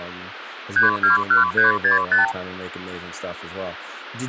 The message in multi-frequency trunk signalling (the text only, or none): 321365